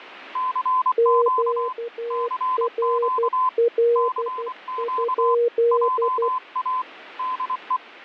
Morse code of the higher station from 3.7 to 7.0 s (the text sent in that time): CQ JA